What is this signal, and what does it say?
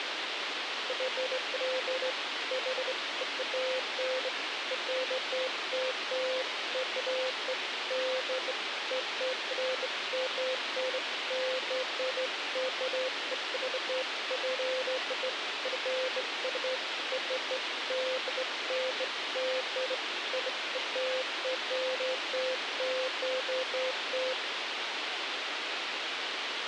Beeps of irregular length, with radio hiss. There is no code.